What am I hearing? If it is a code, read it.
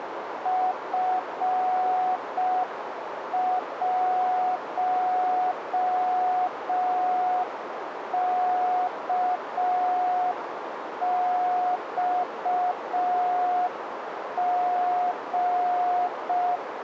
Morse code, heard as a keyed tone, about 5 wpm, 730 Hz, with radio static and a narrow filter. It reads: F1KXG